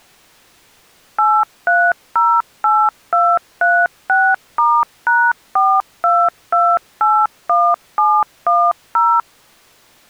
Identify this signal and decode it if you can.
DTMF, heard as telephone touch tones, dialled by machine, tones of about 250 ms. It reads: 8308236*#42281710